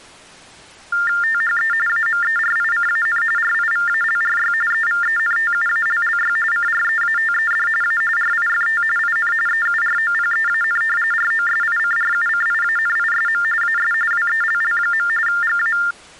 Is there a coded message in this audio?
Yes: TTY/TDD text telephone tones (45.45 baud Baudot) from 0.9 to 15.9 s, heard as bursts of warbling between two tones, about 400 Hz shift, 1600 Hz centre. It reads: THE AMERICAN RIVALRY EVENTUALLY CREATED A RIFT IN EUROPEAN ROSICRUCIANISM AS WELL. GA